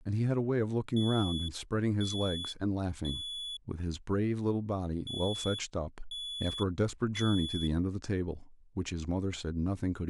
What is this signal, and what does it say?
Alarm pattern, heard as an alarm's beeps, played twice, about 3400 Hz, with speech in English. Temporal three. Smoke or fire, evacuate.